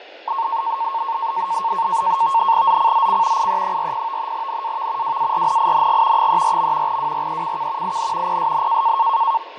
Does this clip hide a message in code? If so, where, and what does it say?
Yes: NAVTEX (SITOR-B), 100 baud, 170 Hz shift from 0.3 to 9.4 s, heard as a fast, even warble, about 1000 Hz centre, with fading and speech in Slovak. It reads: ZCZC IE40 NAV WARNING 34. WRECK IN PSN